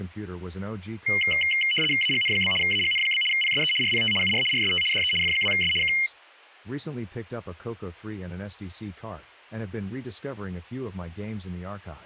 RTTY (75 baud, 850 Hz shift), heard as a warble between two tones, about 2550 Hz centre, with speech in English. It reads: AGN? AGN? PSE RPT UR RST DE F2S K